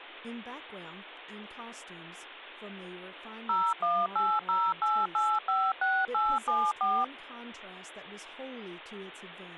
DTMF, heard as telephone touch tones, dialled by machine, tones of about 240 ms, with speech in English. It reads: 01808856874